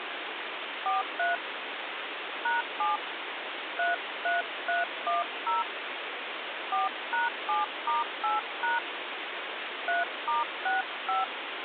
DTMF, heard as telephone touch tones, dialled by hand, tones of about 160 ms, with phone line noise. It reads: 43 #7 33310 4#7*8# 3*65